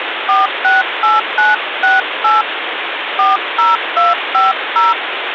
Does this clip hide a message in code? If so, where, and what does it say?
Yes: DTMF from 0.3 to 4.9 s, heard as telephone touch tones, dialled by hand, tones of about 170 ms, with phone line noise. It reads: 468968 40250